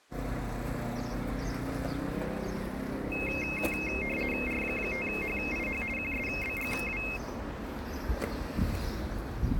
RTTY (50 baud, 450 Hz shift), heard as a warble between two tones, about 2350 Hz centre, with the noise of a residential street. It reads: R5HIH QSBGW